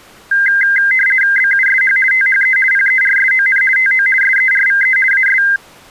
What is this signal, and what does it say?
RTTY (50 baud, 450 Hz shift), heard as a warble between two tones, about 1850 Hz centre. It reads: BUSH THE PERSON TO SERVE AS